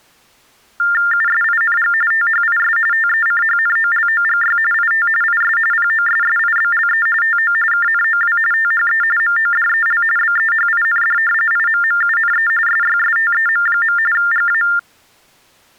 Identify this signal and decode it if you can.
TTY/TDD text telephone tones (45.45 baud Baudot), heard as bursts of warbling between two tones, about 400 Hz shift, 1600 Hz centre. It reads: USING THIS TECHNOLOGY IT IS POSSIBLE TO KNOW THE MODEL BEHIND IMMUNE SYSTEM. GA